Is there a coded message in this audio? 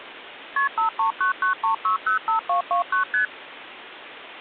Yes: multi-frequency trunk signalling (R1, as on North American trunks) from 0.6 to 3.3 s, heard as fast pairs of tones, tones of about 120 ms, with phone line noise. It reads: KP 53993605229 ST